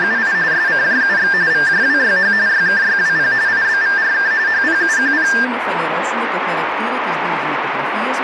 RTTY (45.45 baud, 170 Hz shift), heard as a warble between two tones, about 1700 Hz centre, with radio static. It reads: … SCJUX VJWYH YKYWP IBVRK HPUQP